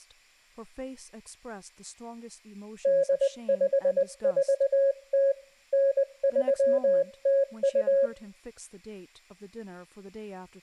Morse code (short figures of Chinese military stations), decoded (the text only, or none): 8540 9302